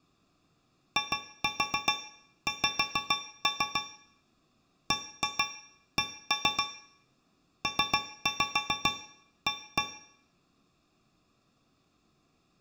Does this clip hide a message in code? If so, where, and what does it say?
Yes: tap code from 1.0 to 10.0 s, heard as taps on a metal pipe, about 7 knocks a second, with room echo. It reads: IX BC PA